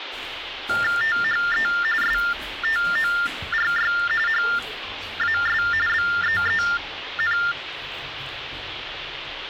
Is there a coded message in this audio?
Yes: TTY/TDD text telephone tones (45.45 baud Baudot) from 0.7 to 7.5 s, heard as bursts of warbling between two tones, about 400 Hz shift, 1600 Hz centre, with phone line noise and the noise inside a lift. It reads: THE STORY HAS BEEN